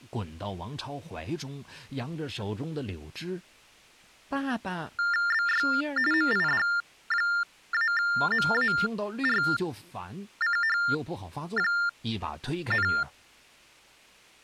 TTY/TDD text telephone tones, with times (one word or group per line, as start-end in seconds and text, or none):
5.3-5.7 BY
6.1-12.9 MID-MARCH,